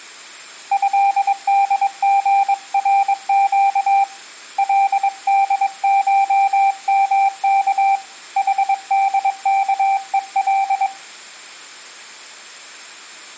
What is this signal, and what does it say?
Morse code (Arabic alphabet), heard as a keyed tone, hand-sent with a paddle, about 22 wpm, 790 Hz, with room echo. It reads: هدغرق لدشمك حدكءل